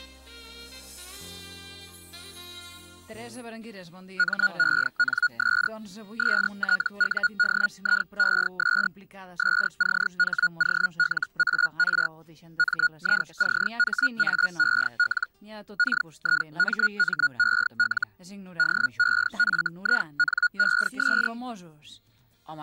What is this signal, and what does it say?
Hellschreiber (Feld-Hell, 122.5 baud), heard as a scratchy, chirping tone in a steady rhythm, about 1440 Hz. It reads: MENS STUDIES SCHOLAR MICHAEL KIMMEL DEFINES